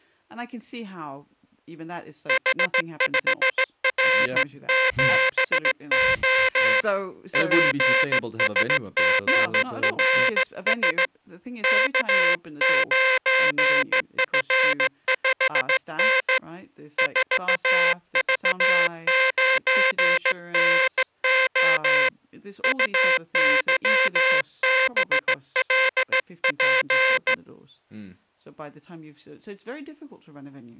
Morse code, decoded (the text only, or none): H5R7O PSGRS K9F5N 4V9NO UYBLP